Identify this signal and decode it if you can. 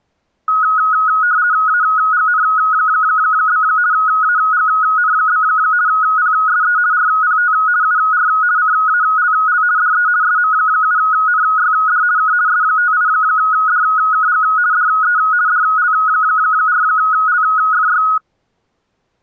RTTY (50 baud, 170 Hz shift), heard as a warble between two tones, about 1360 Hz centre. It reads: AGN? AGN? PSE RPT UR CALL DE SM7NYD K S58DKG DE DL4LFY